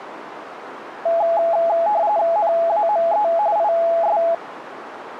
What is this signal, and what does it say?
RTTY (45.45 baud, 170 Hz shift), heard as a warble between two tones, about 760 Hz centre, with radio static. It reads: NAME IS